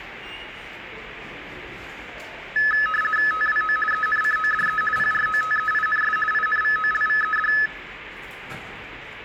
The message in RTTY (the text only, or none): TWO ENCODE PROTEINS INVOLVED